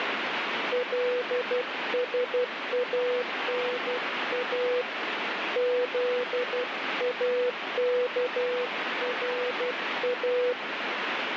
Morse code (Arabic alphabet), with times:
0.7-4.8 لسانا
5.6-10.5 ذاكرا

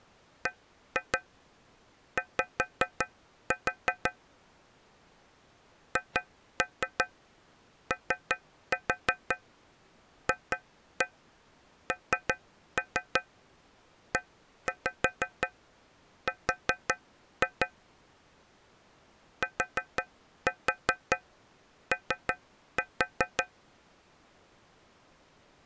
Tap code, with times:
0.5-4.1 BY
6.0-17.7 HOFNER
19.4-23.4 TO

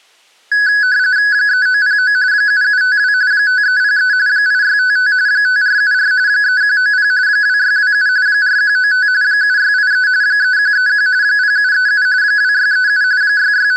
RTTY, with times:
1.3-2.1 3909
2.3-3.1 7752
3.3-4.1 5303
4.3-5.1 8655
5.3-6.1 5474
6.3-7.1 3190
7.3-8.1 2627
8.3-9.1 4195
9.2-10.1 7683
10.2-11.1 3131
11.2-12.1 0737
12.2-13.0 2637
13.2-13.8 …

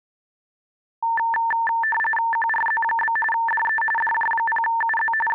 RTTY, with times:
2.3-3.2 QRZ?
3.3-3.8 DE
4.0-5.1 DJ0UZ
5.3-5.3 …

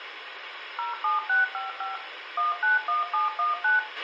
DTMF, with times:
0.8-2.0 07655
2.4-3.8 191719

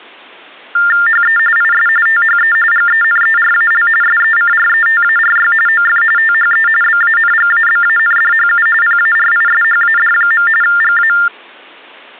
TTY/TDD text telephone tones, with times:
1.1-1.4 HE
1.6-1.9 IS
2.1-2.6 THE
2.7-3.9 GENERAL
4.0-5.5 SECRETARY
5.7-6.0 OF
6.2-6.7 THE
6.8-8.7 BANGABANDHU
8.8-10.5 PARISHAD.
10.6-11.1 GA

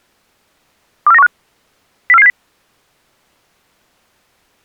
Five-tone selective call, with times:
1.1-1.3 24915
2.1-2.3 04470

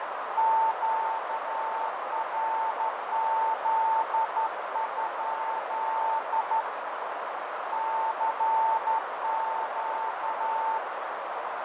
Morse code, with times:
0.4-6.6 QRZ?
7.7-10.8 CQ

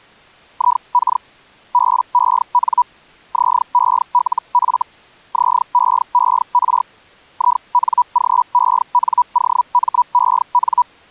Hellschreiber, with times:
0.5-1.2 IK
1.7-2.8 BEN
3.3-4.8 ZELF
5.3-6.8 ZEER
7.3-10.8 INGENOMEN

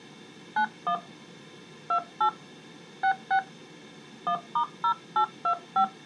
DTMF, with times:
0.6-1.0 91
1.9-2.3 28
3.0-3.4 66
4.3-5.8 1*0825

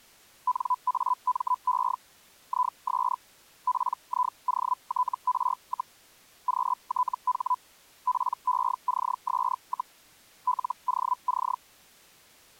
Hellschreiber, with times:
0.5-2.0 NAME
2.5-3.2 IS
3.7-6.0 PIOTR,
6.5-7.6 QTH
8.1-10.0 PECS,
10.5-11.6 LOC

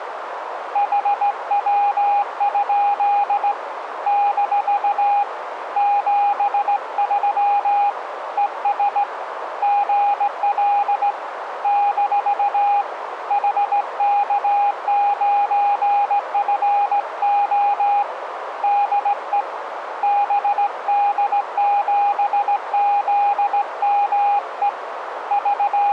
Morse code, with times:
0.8-3.5 HW?
4.1-5.2 -
5.8-7.9 73
8.4-9.0 ES
9.6-11.1 GL
11.6-12.8 -
13.3-18.0 HK9FO
18.6-19.4 DE
20.0-24.7 BD7ZME
25.3-25.9 …

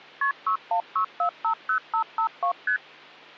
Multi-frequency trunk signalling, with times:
0.2-0.3 KP
0.5-2.5 616450552
2.7-2.8 ST

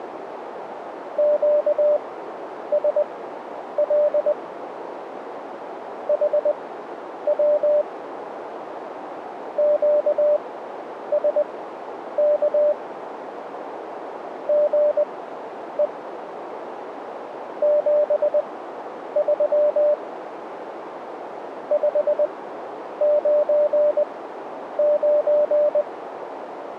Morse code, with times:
1.2-4.3 QSL
6.1-7.8 HW
9.6-12.7 QSK
14.5-15.9 GE
17.6-19.9 73
21.7-25.8 599

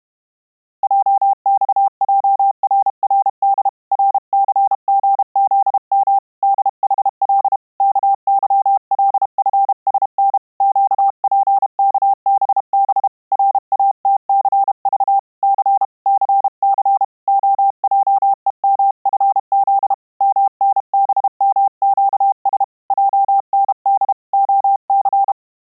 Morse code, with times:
0.8-3.7 JXJRRD
3.9-6.2 RCGZM
6.4-7.6 DHL
7.8-10.4 KYLFSN
10.6-13.1 QPKBB
13.3-15.2 RATCV
15.4-15.8 C
16.1-17.0 CC
17.3-19.9 OJEMFZ
20.2-22.6 MNBMQS
22.9-24.1 JND
24.3-25.3 OC

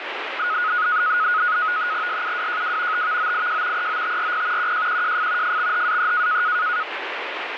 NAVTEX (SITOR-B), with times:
2.1-3.1 SUWJW
2.9-3.9 TVOIJ
3.8-4.7 EOTRP
4.6-5.6 QJQJF
5.4-6.4 FXHAE

